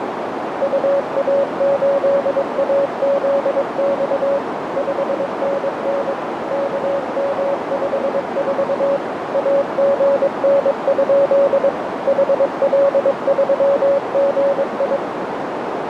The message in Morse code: UA8AZX 5NN KM54 AGN? HL3GI

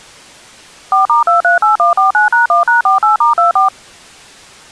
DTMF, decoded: 4*238149#1#48*24

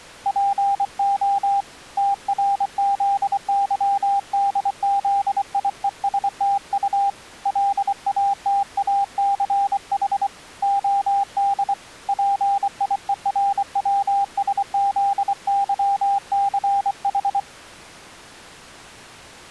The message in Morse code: PO TRZYDZIESTU LATACH OD PIERWSZYCH

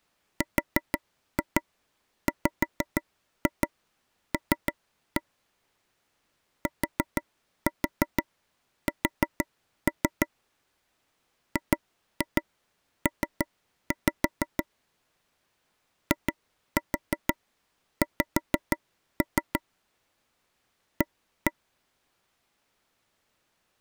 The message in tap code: RWL TS GP IX A

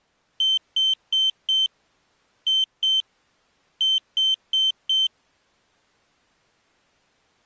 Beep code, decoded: 4-2-4

